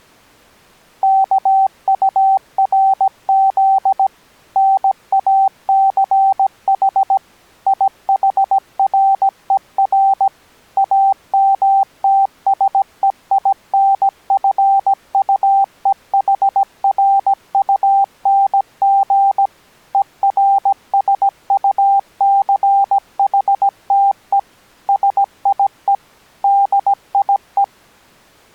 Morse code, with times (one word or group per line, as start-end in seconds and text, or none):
1.0-4.1 KURZ
4.6-7.2 NACH
7.7-10.3 IHRER
10.8-19.5 AMTSEINFUEHRUNG
19.9-24.4 ERSUCHTE
24.9-25.9 SIE
26.4-27.6 DIE